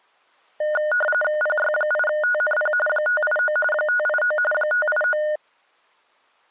RTTY (45.45 baud, 850 Hz shift), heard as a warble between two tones, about 1030 Hz centre. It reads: PY8TNP 589 589 589